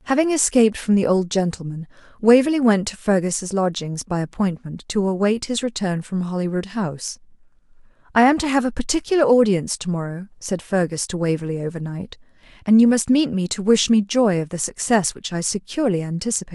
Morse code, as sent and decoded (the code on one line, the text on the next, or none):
none